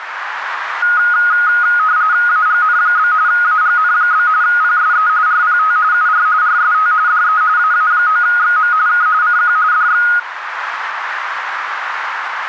RTTY (45.45 baud, 170 Hz shift), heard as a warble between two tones, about 1350 Hz centre, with radio static and a narrow filter. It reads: AGN? AGN? PSE RPT UR RST DE AA9XM K CQ DX